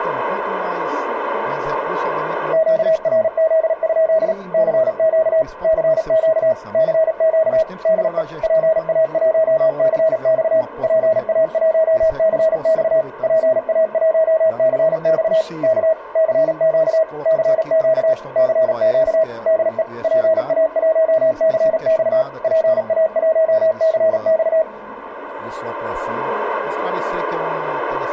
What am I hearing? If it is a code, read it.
Morse code, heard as a keyed tone, machine-sent, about 37 wpm, 640 Hz. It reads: QRZ? CQ CQ CQ DE PA1CX PA1CX PA1CX K CQ CQ CQ DE PA1CX PA1CX